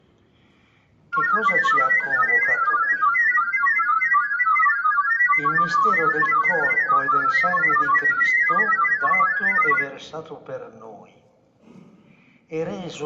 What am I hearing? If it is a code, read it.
Multi-tone FSK (Olivia or MFSK type), about 1000 Hz wide, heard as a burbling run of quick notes, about 31.25 baud, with room echo.